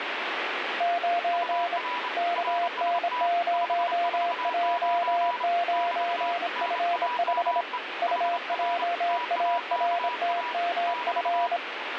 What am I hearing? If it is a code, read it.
Morse code, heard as two keyed tones, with radio static. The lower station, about 26 wpm, 690 Hz: 9 KN0J9F5 UJARTMF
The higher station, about 28 wpm, 980 Hz: UR RST 549 <BT> NAME HR TAKA <BT>